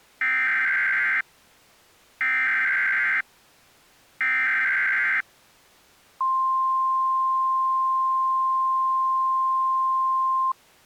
Emergency Alert System (SAME) tones (header bursts, then the 1050 Hz attention tone), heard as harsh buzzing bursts, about 520.83 baud.